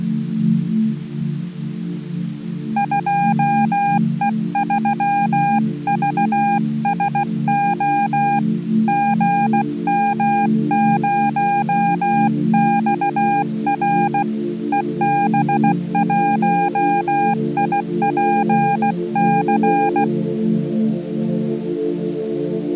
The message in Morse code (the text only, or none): 2E3VSO GM0XR EB1IPC